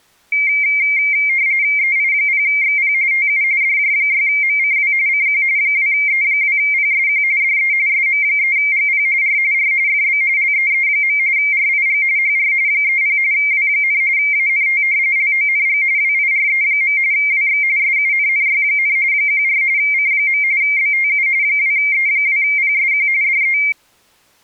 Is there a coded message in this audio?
Yes: RTTY (45.45 baud, 170 Hz shift) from 0.3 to 23.7 s, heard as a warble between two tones, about 2200 Hz centre. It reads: EI0XP TU DJ6MCW CQ 2E2PSQ DE SM3GP R R FB LEE. RIG HR 30 W, ANT LONG WIRE. WX SUNNY, 14 C. BTU 2E2PSQ DE